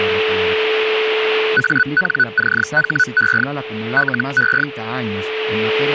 Hellschreiber (Feld-Hell, 122.5 baud), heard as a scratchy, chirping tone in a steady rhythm, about 1490 Hz, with a steady whistle near 440 Hz. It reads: ANCHE LE